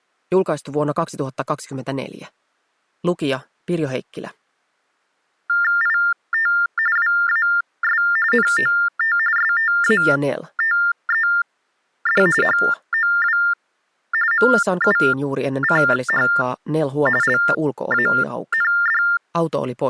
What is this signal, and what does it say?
TTY/TDD text telephone tones (45.45 baud Baudot), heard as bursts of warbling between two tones, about 400 Hz shift, 1600 Hz centre. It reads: IT WAS NOT STATED HOW MUCH LAND